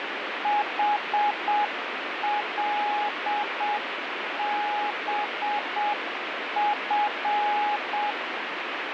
Morse code, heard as a keyed tone, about 7 wpm, 830 Hz, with radio static. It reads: HLBF